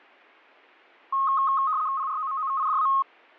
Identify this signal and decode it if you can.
RTTY (75 baud, 170 Hz shift), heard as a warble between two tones, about 1170 Hz centre. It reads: PROMOVIDA